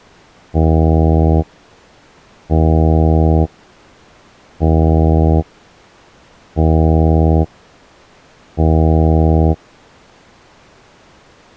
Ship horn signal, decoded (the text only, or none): 5 short